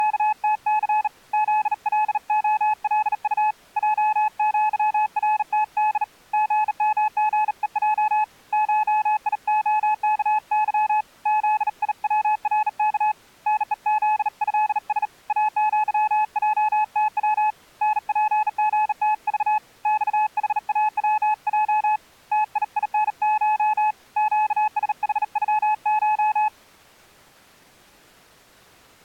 Morse code (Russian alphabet), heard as a keyed tone, hand-sent with a bug key, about 38 wpm, 860 Hz. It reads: … ЗЛОЛУ ЙЪРТД ГМГЕЙ ШИОКЫ ЗИВРК НЕЗЭС АЪЙТВ НПГТЖ ЬХАВЙ ТИИНШ ЩСХЮШ